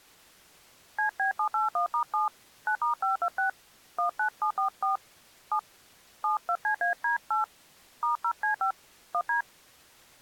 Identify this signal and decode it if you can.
DTMF, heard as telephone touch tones, dialled by hand, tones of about 110 ms. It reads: CB781*7 9*526 19744 7 72CAD8 *0C5 1D